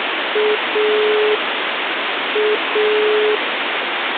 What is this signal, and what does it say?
Telephone call progress tone (pulsed, as in Italy), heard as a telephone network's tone, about 420 Hz, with phone line noise. Dial tone.